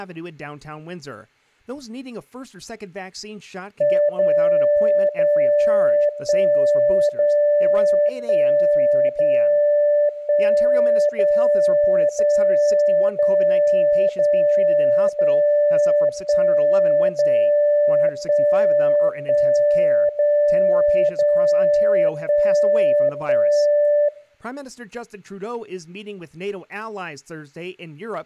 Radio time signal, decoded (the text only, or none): 0 0 1 0 1 0 1 0 0 0 0 0 1 0 1 1 0 0 1 1